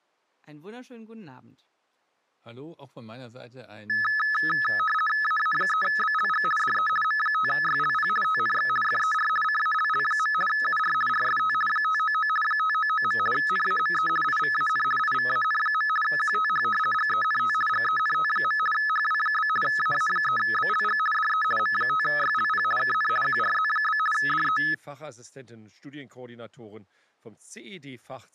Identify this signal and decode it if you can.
RTTY (50 baud, 450 Hz shift), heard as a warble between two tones, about 1500 Hz centre. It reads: AA3BLG DE M5YLP TNX FER CALL. UR RST 599 599. NAME IVAN IVAN. QTH GENT GENT. HW? AA3BLG DE M5YLP KN QRZ? DE